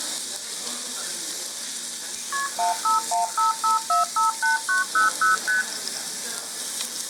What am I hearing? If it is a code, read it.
Multi-frequency trunk signalling (R1, as on North American trunks), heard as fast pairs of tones, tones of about 140 ms, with the noise of a restaurant. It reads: KP 15155458900 ST